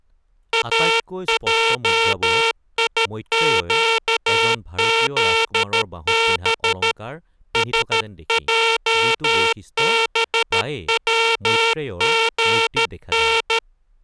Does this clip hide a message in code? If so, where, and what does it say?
Yes: Morse code (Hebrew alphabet) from 0.5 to 13.6 s, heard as a buzzer, hand-sent with a paddle, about 13 wpm, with speech in Assamese. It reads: אעיקזב שעבצגן